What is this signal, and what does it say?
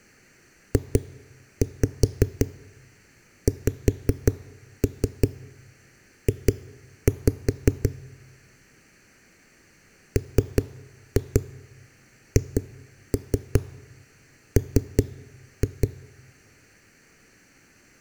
Tap code, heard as knocks on a wall, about 5 knocks a second. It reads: JXJ MHM